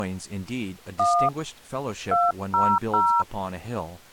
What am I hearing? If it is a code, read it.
DTMF, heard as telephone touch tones, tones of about 250 ms, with speech in English. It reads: 1 200